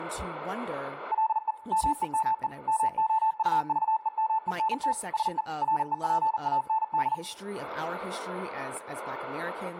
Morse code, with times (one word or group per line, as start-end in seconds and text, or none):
1.1-1.5 LE
1.7-2.5 MEME
2.7-4.9 MOUVEMENT
5.1-5.4 SE
5.6-7.1 REPAND